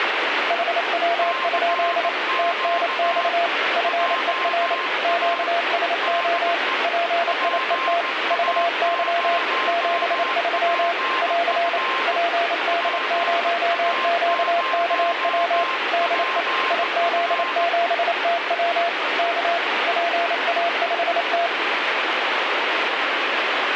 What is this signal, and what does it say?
Morse code, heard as two keyed tones, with heavy radio static. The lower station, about 28 wpm, 680 Hz: HW? TNX FER QSO PIET VY 73 <AR> PD0QKW DE IZ7TW K PA5T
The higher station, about 18 wpm, 1050 Hz: CQ JA DE PA0PF PA0PF